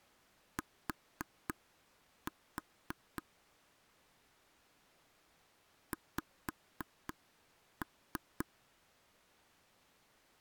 Tap code, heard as taps on a table, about 3 knocks a second. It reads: T X